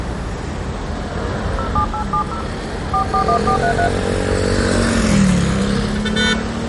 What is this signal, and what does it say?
DTMF, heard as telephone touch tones, dialled by hand, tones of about 90 ms, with room echo and street noise. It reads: 07870 441433